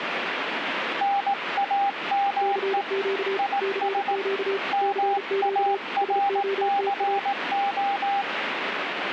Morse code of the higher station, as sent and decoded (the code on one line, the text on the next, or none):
-. .- -- . / .. ... / -- .- .-. -.-. ---
NAME IS MARCO